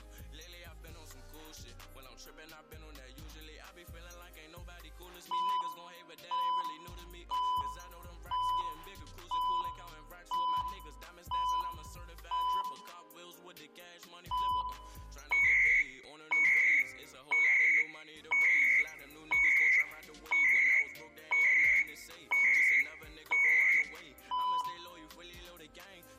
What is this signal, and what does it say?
Radio time signal (CHU, Canada), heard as beeps and data bursts, one a second, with room echo.